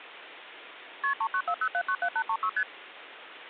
Multi-frequency trunk signalling (R1, as on North American trunks), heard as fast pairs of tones, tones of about 70 ms, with phone line noise. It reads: KP 3940797836 ST